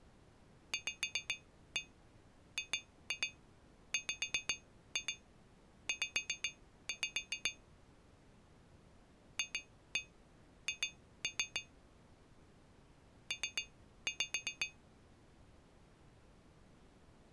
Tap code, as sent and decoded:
5-1 2-2 5-2 5-5 / 2-1 2-3 / 3-5
VGWZ FH P

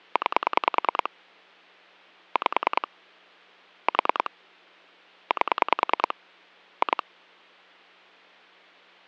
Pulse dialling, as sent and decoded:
9 / 5 / 4 / 8 / 2
9 5 4 8 2

